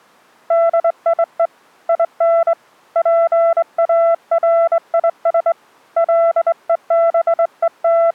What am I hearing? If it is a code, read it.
Morse code, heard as a keyed tone, hand-sent with a straight key, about 23 wpm, 670 Hz. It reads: DIE IN PARIS …